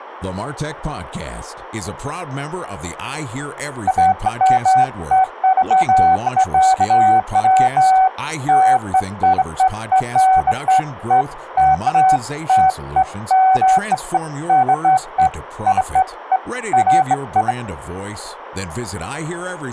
Beeps of irregular length, with speech in English. There is no code.